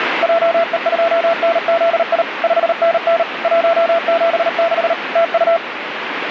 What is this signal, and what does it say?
Morse code, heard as a keyed tone, machine-sent, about 38 wpm, 670 Hz, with radio static. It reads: JE2NZI 5NN 176 TU